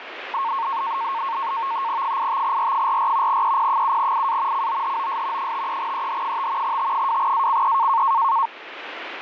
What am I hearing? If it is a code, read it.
NAVTEX (SITOR-B), 100 baud, 170 Hz shift, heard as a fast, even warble, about 1000 Hz centre, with radio static. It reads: 85R44 EP7IA COHOS 53EH5 T2ACE